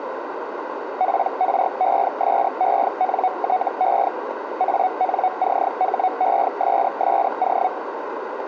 Hellschreiber (Feld-Hell, 122.5 baud), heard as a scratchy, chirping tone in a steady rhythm, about 740 Hz, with radio static and a narrow filter. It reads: PRESENTE ANCHESSO